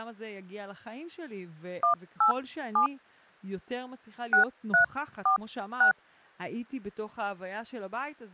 DTMF, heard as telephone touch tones, dialled by hand, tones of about 110 ms, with speech in Hebrew. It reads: 187 6346